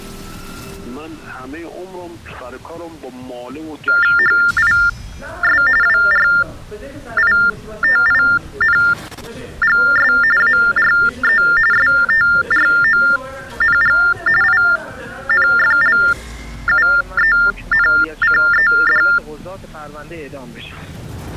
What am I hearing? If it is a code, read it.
TTY/TDD text telephone tones (45.45 baud Baudot), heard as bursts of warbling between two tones, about 400 Hz shift, 1600 Hz centre. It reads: HIS WRITINGS ARE STRONG INFLUENCED